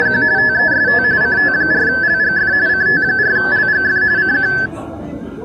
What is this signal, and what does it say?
RTTY (45.45 baud, 170 Hz shift), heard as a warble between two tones, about 1650 Hz centre, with the noise of a cafe. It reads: … TEST CT4LGF CT4LGF CQ